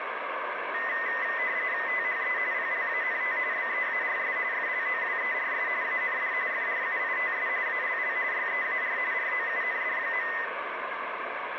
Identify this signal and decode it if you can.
RTTY (45.45 baud, 170 Hz shift), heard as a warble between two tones, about 1900 Hz centre, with radio static and room echo. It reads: THE PLANT BEARS FLOWERS AND FRUITS ALL YEAR ROUND.